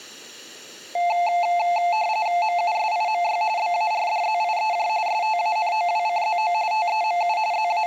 RTTY (45.45 baud, 170 Hz shift), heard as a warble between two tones, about 780 Hz centre, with room echo. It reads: MUSIMY BARDZIEJ STANOWCZO TEMU …